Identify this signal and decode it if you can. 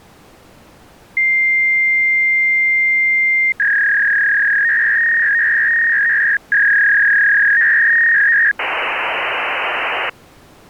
Fax machine handshake, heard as a long tone, a warble and hiss.